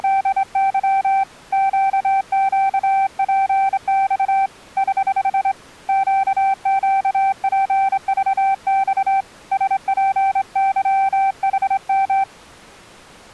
Morse code, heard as a keyed tone, hand-sent with a straight key, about 25 wpm, 780 Hz. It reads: … QQPX <HH> QQPVX SPYHM